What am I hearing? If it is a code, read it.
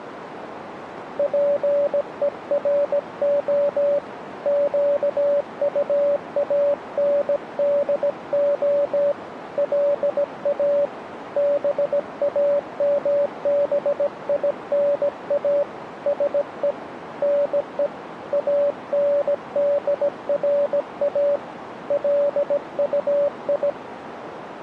Morse code, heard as a keyed tone, hand-sent with a bug key, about 17 wpm, 570 Hz, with radio static and a narrow filter. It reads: PERO QUANDO LA BAMBINA SE NE ANDRA LUI